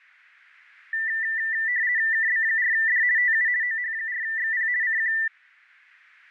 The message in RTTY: KB4D TU OH4XP CQ

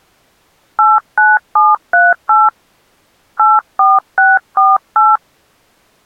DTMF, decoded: 89738 84648

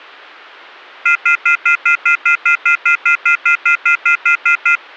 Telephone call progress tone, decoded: off-hook warning tone

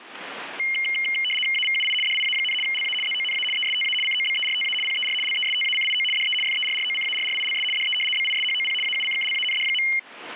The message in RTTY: AVUI DIA, LA ZONA ESTA COBERTA PER LESTACIO DE FERROCARRILS DE BISHOP AUCKLAND.

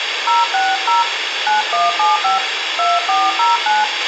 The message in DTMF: 060 9175 2409

